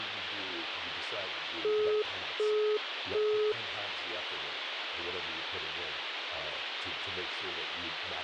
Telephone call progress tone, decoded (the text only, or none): busy tone